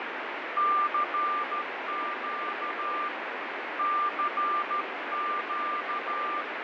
Morse code, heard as a keyed tone, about 13 wpm, 1190 Hz, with heavy radio static and fading. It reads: CQ CQ